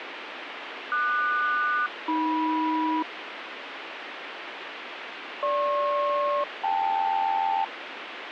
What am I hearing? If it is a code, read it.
Aircraft SELCAL, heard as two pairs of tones, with radio hiss. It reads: QS-AM GP-KL